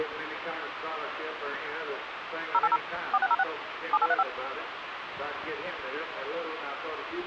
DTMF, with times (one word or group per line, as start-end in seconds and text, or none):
2.5-2.8 080
3.1-3.4 4606
3.9-4.2 7835